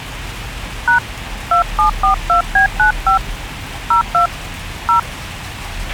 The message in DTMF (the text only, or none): # 2742B95 02 0